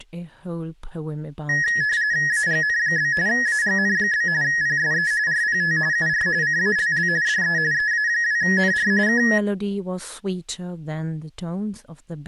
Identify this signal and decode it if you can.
RTTY (45.45 baud, 170 Hz shift), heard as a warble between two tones, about 1800 Hz centre, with speech in English. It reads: AGN? AGN? PSE RPT UR CALL DE EA2NR K